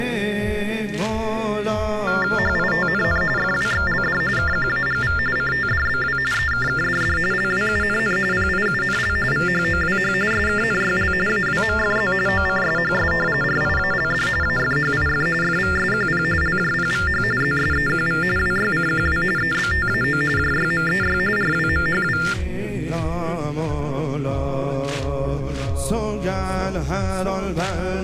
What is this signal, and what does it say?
TTY/TDD text telephone tones (45.45 baud Baudot), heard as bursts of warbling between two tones, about 400 Hz shift, 1600 Hz centre. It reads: HITNN FWXLD KQAGV CTDBW EKKDD LWUNN PIUNL VHOWH SKNYL AWMFZ OCSHS RIALD AFHIF FVSQP LJPVH ZSEQV WYCQW EBTAO JYMEY RWMHW